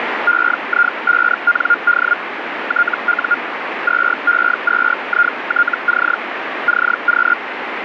Hellschreiber (Feld-Hell, 122.5 baud), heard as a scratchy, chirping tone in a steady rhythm, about 1420 Hz, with radio static. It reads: EI5ND TU 2E2ITC CQ